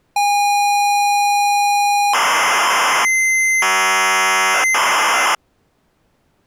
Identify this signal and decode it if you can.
ZX Spectrum tape loading, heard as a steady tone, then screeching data.